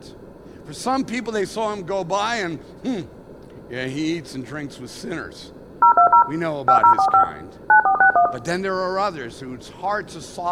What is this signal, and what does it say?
DTMF, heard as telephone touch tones, dialled by machine, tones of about 100 ms, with room echo and speech in English. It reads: 020 5045 9461